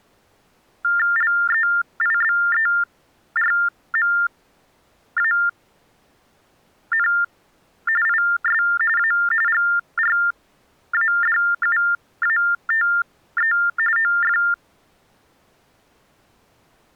TTY/TDD text telephone tones (45.45 baud Baudot), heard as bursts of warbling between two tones, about 400 Hz shift, 1600 Hz centre. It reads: LEIBERMAN IS A GRADUATE OF